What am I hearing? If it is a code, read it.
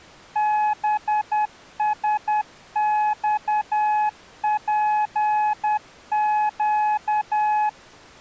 Morse code, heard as a keyed tone, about 10 wpm, 850 Hz. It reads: BSXPQ